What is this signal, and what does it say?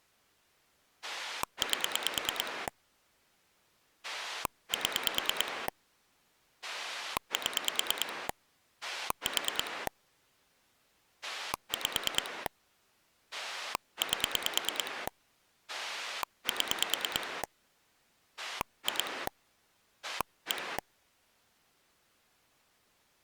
Pulse dialling, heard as a rotary dial, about 9 pulses a second. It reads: 8 7 7 4 5 8 7 2 1